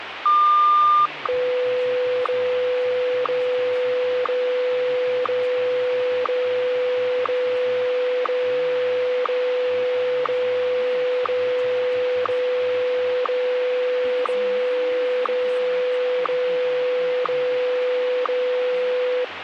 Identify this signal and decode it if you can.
Radio time signal (WWVH, Hawaii), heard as ticks, one a second, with radio static and speech in English.